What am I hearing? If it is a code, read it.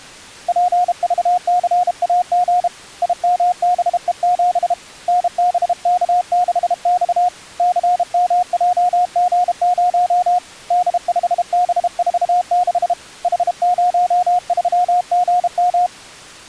Morse code, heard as a keyed tone, hand-sent with a paddle, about 32 wpm, 720 Hz. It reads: PVCAG IMBE7 NBK6X CMJG0 D5B46 H03GM